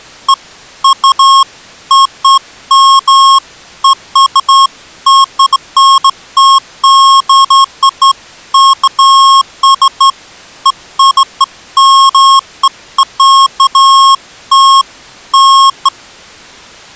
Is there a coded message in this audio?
No, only beeps of irregular length.